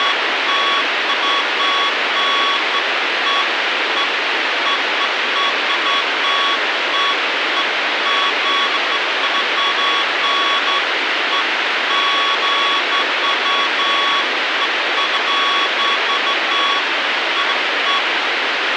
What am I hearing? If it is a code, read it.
Beeps of irregular length, with radio hiss. There is no code.